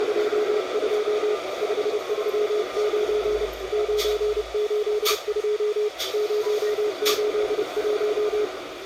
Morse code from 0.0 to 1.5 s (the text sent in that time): …